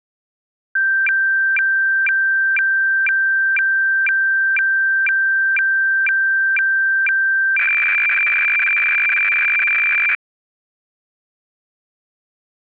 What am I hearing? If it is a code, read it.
Weather fax (radiofax), 120 lines a minute, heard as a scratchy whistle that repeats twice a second.